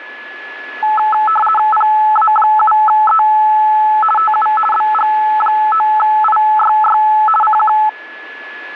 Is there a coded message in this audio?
Yes: RTTY (50 baud, 450 Hz shift) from 0.8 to 7.9 s, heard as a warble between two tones, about 1080 Hz centre, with a steady whistle near 1710 Hz. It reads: PA7E TU BG9IYY CQ